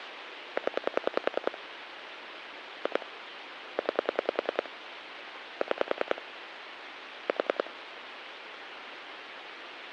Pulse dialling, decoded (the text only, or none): 0 2 9 6 4